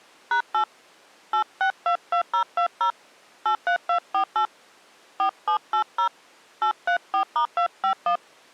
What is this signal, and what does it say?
DTMF, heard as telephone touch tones, dialled by hand, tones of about 90 ms. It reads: #8 8622020 83248 4780 834*251